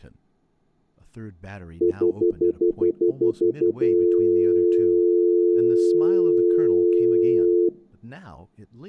Telephone call progress tone (North American plan), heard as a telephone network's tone, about 350, 440 Hz, 0.1 s on and 0.1 s off, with room echo and speech in English. Stutter dial tone.